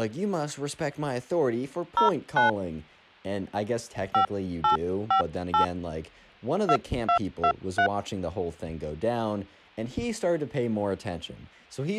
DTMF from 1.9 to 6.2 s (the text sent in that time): 09 5858